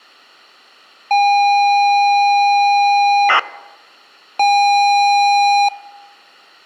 ZX Spectrum tape loading, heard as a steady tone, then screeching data.